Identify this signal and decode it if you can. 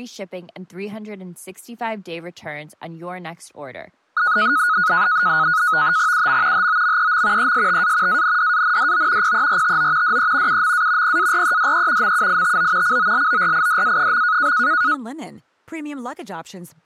NAVTEX (SITOR-B), 100 baud, 170 Hz shift, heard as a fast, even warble, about 1360 Hz centre, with speech in German. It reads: UM HOMEM ESTA ANDANDO PERTO DE UMA PAREDE MUITO COLORIDA.